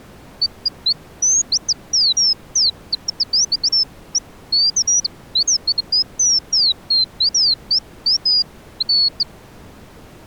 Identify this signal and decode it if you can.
Bird-like chirps. There is no code.